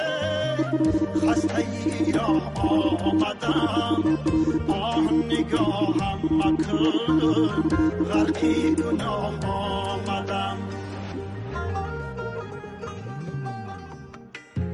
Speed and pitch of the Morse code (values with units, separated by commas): 34 wpm, 320 Hz